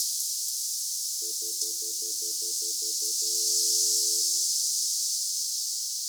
Telephone call progress tone (North American plan), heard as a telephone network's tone, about 350, 440 Hz, 0.1 s on and 0.1 s off, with room echo. Stutter dial tone.